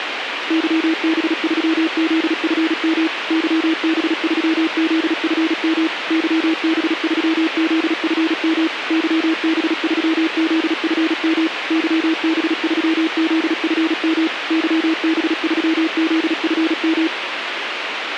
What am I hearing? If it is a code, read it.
Morse code, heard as a keyed tone, machine-sent, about 36 wpm, 320 Hz, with radio hiss. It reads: YB3ZFM YB3ZFM YB3ZFM YB3ZFM YB3ZFM YB3ZFM